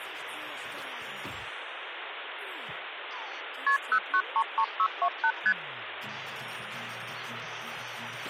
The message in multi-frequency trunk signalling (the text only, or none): KP 0933628 ST